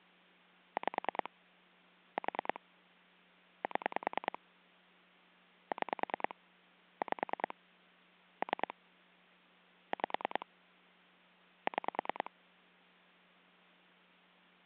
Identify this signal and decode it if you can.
Pulse dialling, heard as clicks on a phone line, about 10 pulses a second. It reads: 5 4 7 6 5 3 5 6